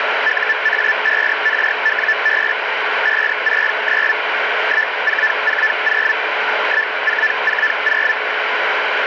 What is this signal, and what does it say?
Hellschreiber (Feld-Hell, 122.5 baud), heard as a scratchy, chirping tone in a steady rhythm, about 1750 Hz, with radio static. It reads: UA5RWB 569 1440 1440